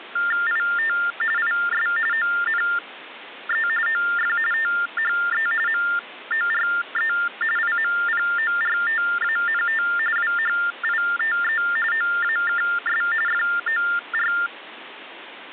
TTY/TDD text telephone tones (45.45 baud Baudot), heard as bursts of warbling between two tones, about 400 Hz shift, 1600 Hz centre, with phone line noise. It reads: IT IS ONE OF THE MORE IMPORTANT WHITE OAKS FOR